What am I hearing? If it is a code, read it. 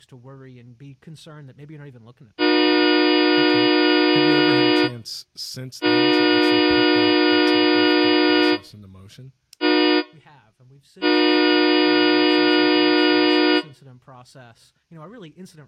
Train horn signal, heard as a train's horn, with speech in English. 2 long, 1 short, 1 long. On North American railways: approaching a public crossing.